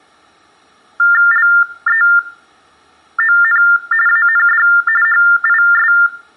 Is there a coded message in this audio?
Yes: TTY/TDD text telephone tones (45.45 baud Baudot) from 1.0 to 6.1 s, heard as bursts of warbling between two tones, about 400 Hz shift, 1600 Hz centre, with room echo. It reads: LEON AND HIS